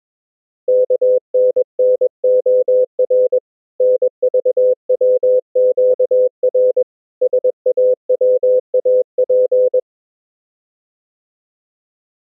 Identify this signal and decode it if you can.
Morse code, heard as a keyed tone, hand-sent with a paddle, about 21 wpm, 510 Hz. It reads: KNNOR NVWQR SAWAP